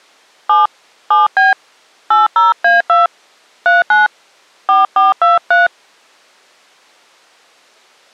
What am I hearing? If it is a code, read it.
DTMF, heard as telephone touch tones, dialled by hand, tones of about 160 ms. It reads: 7 7B 80A2 39 4423